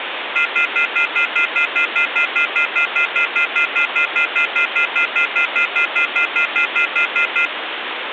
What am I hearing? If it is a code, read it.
Telephone call progress tone (North American plan), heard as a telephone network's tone, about 1400, 2050, 2450, 2600 Hz, 0.1 s on and 0.1 s off, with phone line noise. Off-hook warning tone.